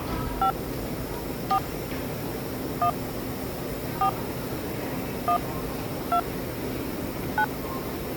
DTMF, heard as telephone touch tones, dialled by hand, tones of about 80 ms, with the noise of a subway station. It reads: 5 4 1 4 1 2 9